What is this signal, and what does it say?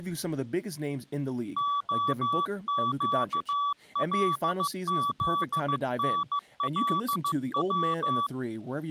Morse code (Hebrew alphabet), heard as a keyed tone, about 15 wpm, 1150 Hz, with speech in English. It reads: הקלזנלץ